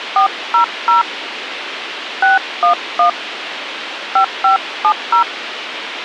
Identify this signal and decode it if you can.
DTMF, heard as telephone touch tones, dialled by hand, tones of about 130 ms, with radio hiss. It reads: 400 611 5570